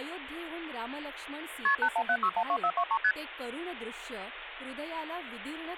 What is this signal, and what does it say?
Multi-frequency trunk signalling (R1, as on North American trunks), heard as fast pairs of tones, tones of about 70 ms, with phone line noise and speech in Marathi. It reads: KP 817612423 ST